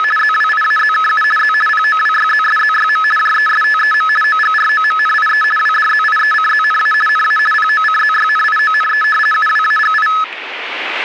RTTY (50 baud, 450 Hz shift), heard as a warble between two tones, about 1500 Hz centre, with static crashes. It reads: … ZWIAZKU Z POWYZSZYM JESTEM OGROMNIE WDZIECZNA NA POCZYNIONE UWAGI